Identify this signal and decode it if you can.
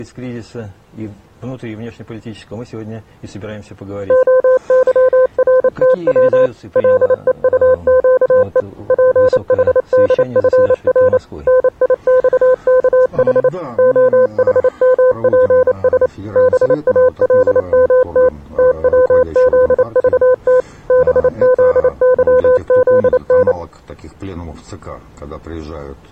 Morse code, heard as a keyed tone, machine-sent, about 28 wpm, 510 Hz. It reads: OYRTW LEUQE PHDFR NIXKH OHMPS BALMT TWZVT BZYZN